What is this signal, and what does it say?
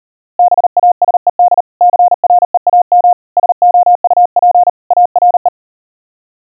Morse code, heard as a keyed tone, hand-sent with a paddle, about 39 wpm, 710 Hz. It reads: BASED CREAM SOUP ARE